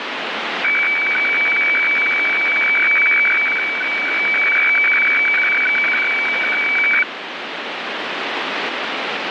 Weather fax (radiofax), 120 lines a minute, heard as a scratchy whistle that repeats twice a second, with radio static.